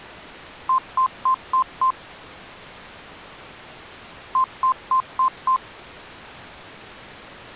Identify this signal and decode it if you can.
Beep code, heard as beeps, played twice, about 1040 Hz. 5 short. In AMI BIOS tables: processor failure; in Dell tables: CMOS battery failure.